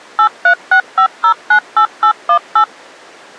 DTMF, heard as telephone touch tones, dialled by machine, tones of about 90 ms. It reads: 8365098818